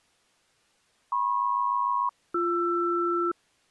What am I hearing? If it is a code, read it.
Aircraft SELCAL, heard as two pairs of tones. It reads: MP-BR